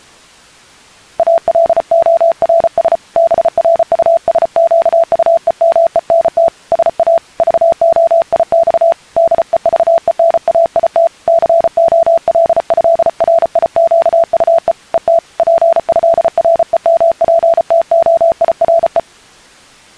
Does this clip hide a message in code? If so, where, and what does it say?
Yes: Morse code (with French letters) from 1.1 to 19.1 s, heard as a keyed tone, hand-sent with a paddle, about 34 wpm, 670 Hz. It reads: ALORS BRUSQUEMENT SA VOIX DEVENAIT COLÉRIQUE ET PÉREMPTOIRE